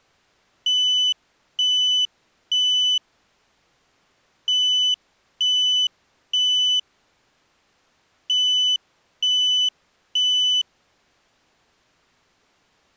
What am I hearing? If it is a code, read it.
Alarm pattern, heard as an alarm's beeps, played three times, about 3000 Hz. Temporal three. Smoke or fire, evacuate.